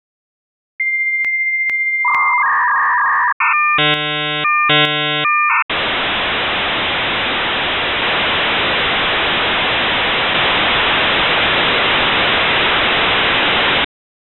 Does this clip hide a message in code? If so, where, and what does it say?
Yes: dial-up modem handshake (V.34 or later) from 0.8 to 13.8 s, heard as a whistle, warbles, then hiss.